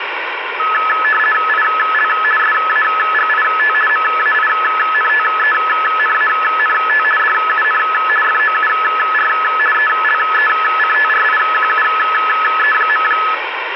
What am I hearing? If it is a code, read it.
RTTY (50 baud, 450 Hz shift), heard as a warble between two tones, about 1500 Hz centre, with radio static. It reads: IL SAGIT MAINTENANT DUN FOUR ELECTRIQUE.